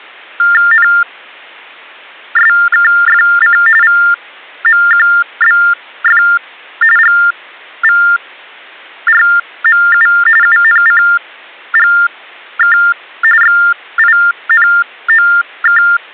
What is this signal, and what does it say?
TTY/TDD text telephone tones (45.45 baud Baudot), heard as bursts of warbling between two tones, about 400 Hz shift, 1600 Hz centre. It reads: NSKFC VMQBF GVRMU UNCGK XINOK